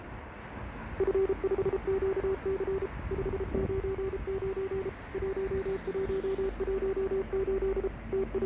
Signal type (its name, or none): Morse code